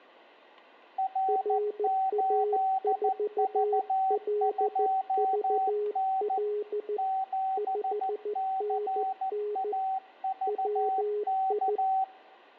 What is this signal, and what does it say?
Morse code, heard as two keyed tones. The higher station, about 14 wpm, 760 Hz: R8V2N 7CAVK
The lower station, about 14 wpm, 420 Hz: RA4LVL 5NN WI